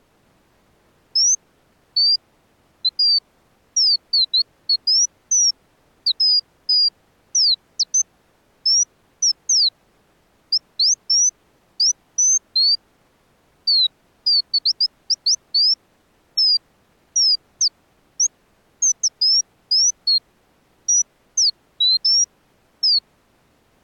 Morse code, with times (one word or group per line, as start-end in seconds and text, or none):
none